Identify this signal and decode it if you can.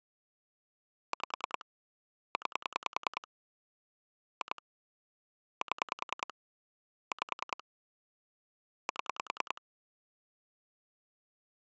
Pulse dialling, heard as clicks on a phone line, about 10 pulses a second. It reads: 5 9 2 7 5 7